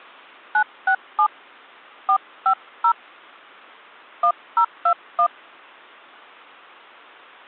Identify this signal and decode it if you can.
DTMF, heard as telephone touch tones, dialled by hand, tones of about 80 ms. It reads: 967 450 1021